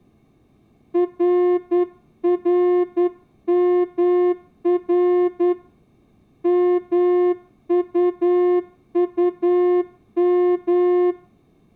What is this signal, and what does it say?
Morse code, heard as a horn, hand-sent with a straight key, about 10 wpm, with room echo. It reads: RRMR MUUM